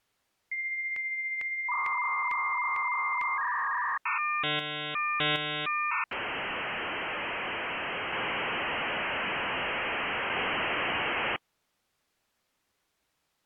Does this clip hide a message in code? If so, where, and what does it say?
Yes: dial-up modem handshake (V.34 or later) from 0.5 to 11.4 s, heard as a whistle, warbles, then hiss.